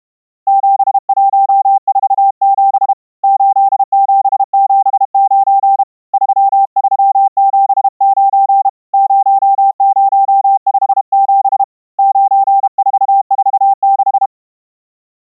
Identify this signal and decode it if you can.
Morse code, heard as a keyed tone, hand-sent with a paddle, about 32 wpm, 790 Hz. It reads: 7147 8779 3379 0057 9446